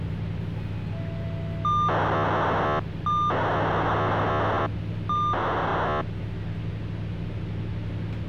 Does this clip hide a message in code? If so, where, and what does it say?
Yes: POCSAG pager data (2400 baud) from 1.6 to 6.0 s, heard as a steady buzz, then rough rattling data, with the noise inside a bus.